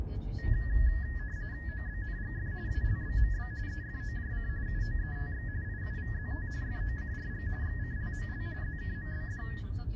RTTY (45.45 baud, 170 Hz shift), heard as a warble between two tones, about 1800 Hz centre, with the noise inside a car. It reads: OBNGF ALBMB EFOJC UOETX IUVZT FOCRG XCLML ZKMBD